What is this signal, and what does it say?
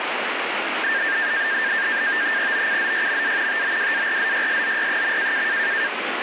NAVTEX (SITOR-B), 100 baud, 170 Hz shift, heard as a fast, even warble, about 1700 Hz centre, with radio static. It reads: OCZYMA TOWARZYSZY.